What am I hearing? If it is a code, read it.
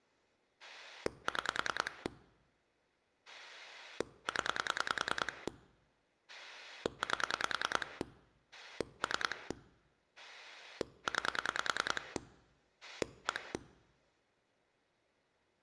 Pulse dialling, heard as a rotary dial, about 10 pulses a second. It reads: 6 0 8 3 9 1